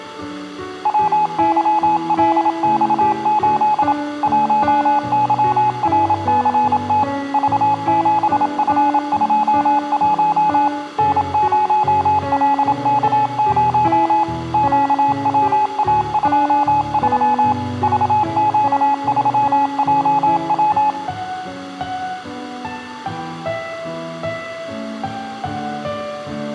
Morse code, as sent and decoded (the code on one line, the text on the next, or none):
.-- -.-- .-.. -..- ---.. / .---- -.-- .-. -.-. - / ...- --... ..-. ..--- .---- / -. ----- .-.. -.- ----- / --.- .-- .- ..--- ...-- / ...- --.- ...-- .--- .--
WYLX8 1YRCT V7F21 N0LK0 QWA23 VQ3JW